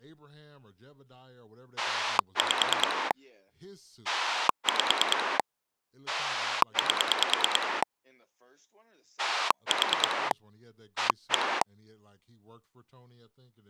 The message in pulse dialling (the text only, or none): 5 5 8 4 1